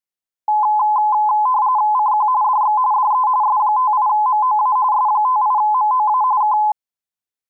RTTY (45.45 baud, 170 Hz shift), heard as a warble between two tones, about 930 Hz centre. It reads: CQ DX DE S58MOA S58MOA K